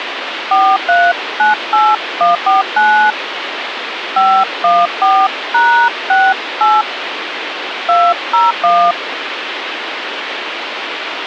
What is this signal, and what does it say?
DTMF, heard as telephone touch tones, dialled by hand, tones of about 240 ms, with phone line noise. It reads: 4398149 514#68 201